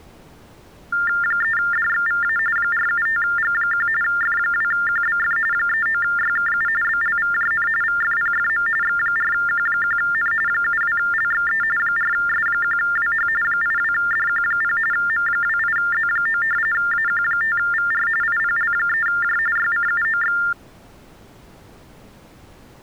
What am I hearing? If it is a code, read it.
TTY/TDD text telephone tones (45.45 baud Baudot), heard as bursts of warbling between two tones, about 400 Hz shift, 1600 Hz centre. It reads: 3DXVA 475G1 F2QBF 39YKU BLVJN VFPFM X4Q1N 72LXE 4S1WH 82DQ0 M28Z9 AQ5VR IPL3J YCUOX